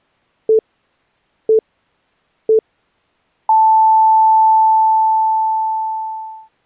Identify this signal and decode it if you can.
Radio time signal (three low pips and a long one an octave up, as on NHK), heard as pips.